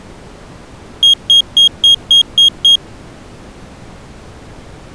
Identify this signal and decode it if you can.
Beep code, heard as a piezo beeper, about 3250 Hz. 7 short. In AMI BIOS tables: virtual mode exception error; in Dell tables: processor failure.